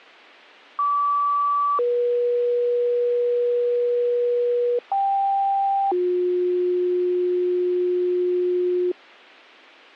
Two-tone page, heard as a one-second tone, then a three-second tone, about 1150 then 480 Hz, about 790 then 360 Hz, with a squelch burst at the end.